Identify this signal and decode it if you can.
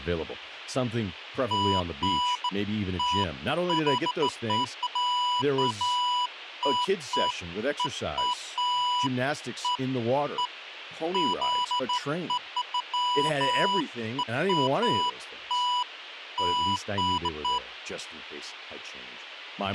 Beeps of irregular length, with a squelch burst at the end and speech in English. There is no code.